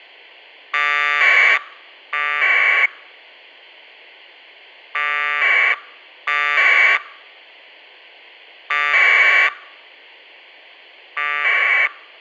Packet radio (AX.25, as in APRS), 1200 baud, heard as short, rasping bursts, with a squelch burst at the end.